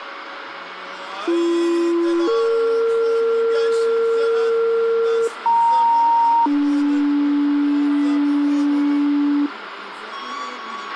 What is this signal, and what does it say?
Two-tone page, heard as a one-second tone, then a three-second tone, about 340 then 460 Hz, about 930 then 290 Hz, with radio hiss and a squelch burst at the end.